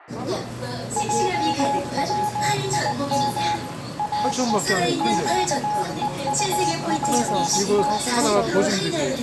Morse code (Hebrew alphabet), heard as a keyed tone, machine-sent, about 19 wpm, 840 Hz, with room echo and the noise of a crowd indoors. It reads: עצים או קוטפת